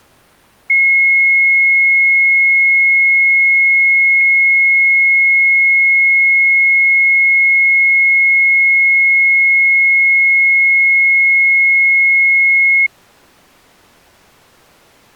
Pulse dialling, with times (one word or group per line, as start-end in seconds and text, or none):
none